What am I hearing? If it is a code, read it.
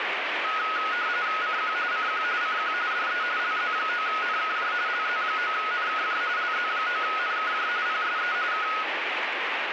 RTTY (45.45 baud, 170 Hz shift), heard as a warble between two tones, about 1360 Hz centre, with radio static. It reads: CQ CQ CQ DE LZ9NKJ LZ9NKJ LZ9NKJ PSE K